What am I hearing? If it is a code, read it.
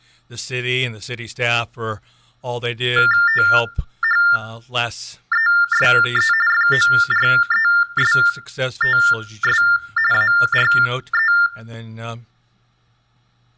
TTY/TDD text telephone tones (45.45 baud Baudot), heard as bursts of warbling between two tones, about 400 Hz shift, 1600 Hz centre, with room echo. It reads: THESE FORESTS ARE